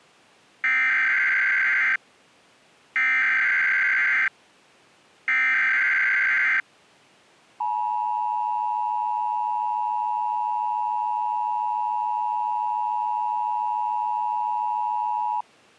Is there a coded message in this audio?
Yes: Emergency Alert System (SAME) tones (header bursts, then the 853 and 960 Hz attention tone) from 0.6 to 15.4 s, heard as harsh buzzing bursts, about 520.83 baud.